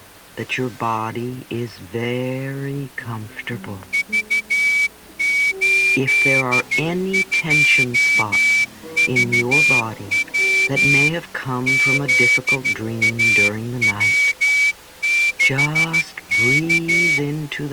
Morse code, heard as a whistle, hand-sent with a straight key, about 13 wpm. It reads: V82VW ZAW6K